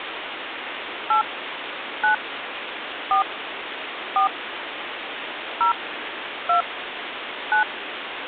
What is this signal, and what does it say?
DTMF, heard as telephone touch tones, dialled by hand, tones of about 110 ms, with phone line noise. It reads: 8 9 4 4 0 2 9